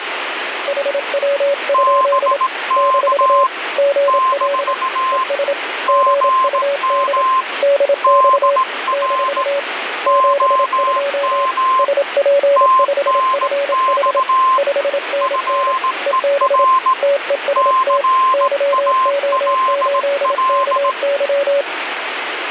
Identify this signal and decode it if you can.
Morse code, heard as two keyed tones, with radio static. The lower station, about 27 wpm, 560 Hz: HW? - GL ES GUD DX - 72 SP5FH 5NN EB TEST YO8KY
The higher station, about 18 wpm, 1050 Hz: BK - GM DR OM TNX FER CALL